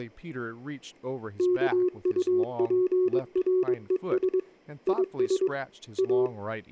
Morse code, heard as a keyed tone, hand-sent with a paddle, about 22 wpm, 370 Hz, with speech in English. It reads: KUPRES IS A